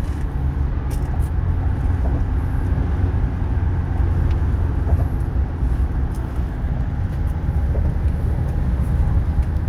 The noise inside a car. There is no code.